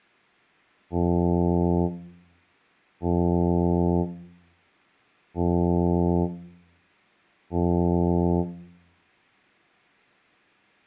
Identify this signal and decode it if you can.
Ship horn signal, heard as a ship's horn, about 90 Hz, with room echo. 4 short. At sea: a pilot vessel's identity signal in fog.